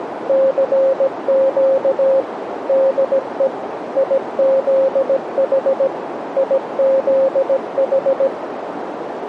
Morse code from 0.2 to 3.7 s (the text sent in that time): CQ DE